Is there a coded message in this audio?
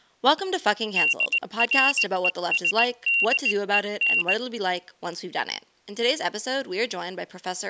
Yes: Morse code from 0.9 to 4.4 s, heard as a high beeper, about 19 wpm, 2750 Hz, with speech in English. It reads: DRESDEN